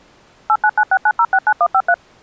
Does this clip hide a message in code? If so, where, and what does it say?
Yes: DTMF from 0.5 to 1.9 s, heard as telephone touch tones, dialled by machine, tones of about 60 ms. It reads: 89969069153